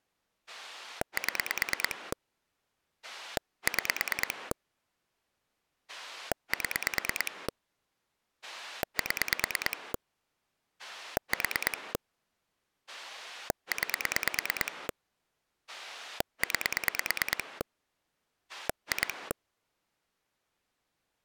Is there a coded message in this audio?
Yes: pulse dialling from 0.5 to 19.3 s, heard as a rotary dial, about 9 pulses a second. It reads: 7 6 7 7 4 9 9 2